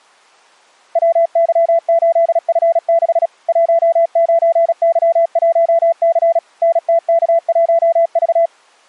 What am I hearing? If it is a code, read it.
Morse code, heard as a keyed tone, machine-sent, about 36 wpm, 670 Hz. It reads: WY8F6 19Y1C NTK1V